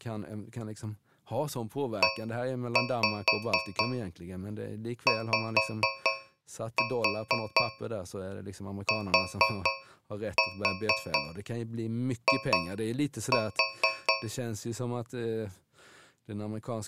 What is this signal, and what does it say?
Tap code, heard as taps on a metal pipe, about 4 knocks a second, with speech in Swedish. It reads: EYTI